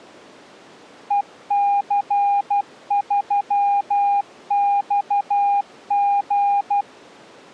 Morse code, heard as a keyed tone, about 12 wpm, 810 Hz. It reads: EC3XG